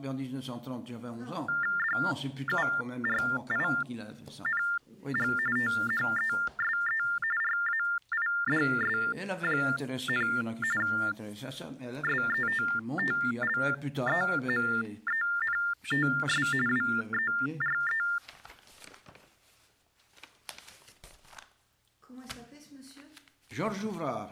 TTY/TDD text telephone tones (45.45 baud Baudot), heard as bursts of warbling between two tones, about 400 Hz shift, 1600 Hz centre. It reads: DURING THESE RAIDS, SETTLEMENTS WERE